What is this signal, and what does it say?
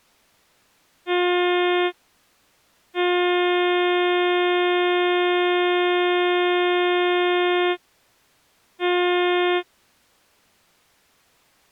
Ship horn signal, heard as a ship's horn, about 360 Hz. 1 short, 1 long, 1 short. At sea: a vessel at anchor warns of its position.